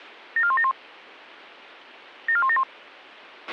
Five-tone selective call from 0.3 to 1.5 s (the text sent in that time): 74171